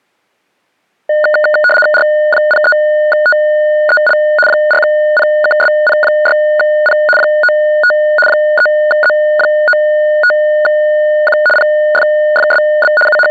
RTTY (75 baud, 850 Hz shift), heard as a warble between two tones, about 1030 Hz centre. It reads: R03TEL 4PKSP6P 95 3Z95Q PFFSB …